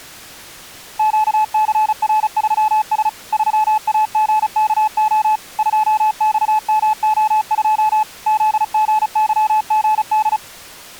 Morse code, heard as a keyed tone, machine-sent, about 35 wpm, 860 Hz. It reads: QCR3S 3AGKO 2XMO2 ZGYGD